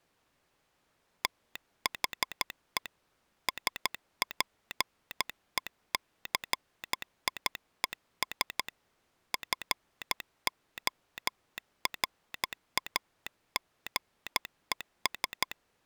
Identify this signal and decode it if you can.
Morse code, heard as a telegraph sounder, hand-sent with a paddle, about 13 wpm. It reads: THE SPECIES FORAGES